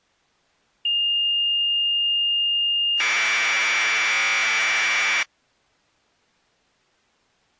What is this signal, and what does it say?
Commodore tape loading (standard loader), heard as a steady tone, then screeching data.